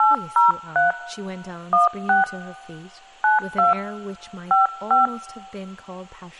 DTMF, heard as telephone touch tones, dialled by hand, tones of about 150 ms, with speech in English. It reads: 803 16 92 55